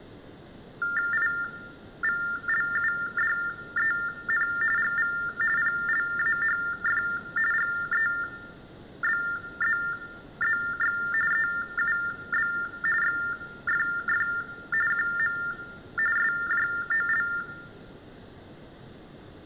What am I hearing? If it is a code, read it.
TTY/TDD text telephone tones (45.45 baud Baudot), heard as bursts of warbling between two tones, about 400 Hz shift, 1600 Hz centre, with room echo. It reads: IVLUDEN GV PLAHF GEBZZX EUB XFF QM SJOL